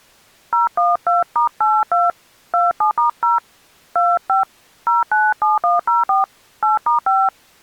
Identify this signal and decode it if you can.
DTMF, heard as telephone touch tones, dialled by hand, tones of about 160 ms. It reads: 012*82 27*0 25 097104 8*5